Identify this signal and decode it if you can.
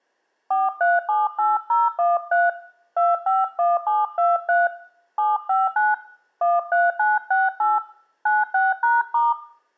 DTMF, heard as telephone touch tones, dialled by hand, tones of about 190 ms, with room echo. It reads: 4378013 251723 759 13968 96#*